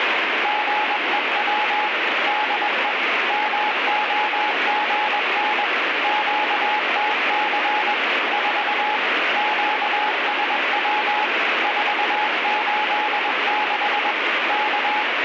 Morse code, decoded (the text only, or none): GEW DE MOGN QTC 4 QSW 486 K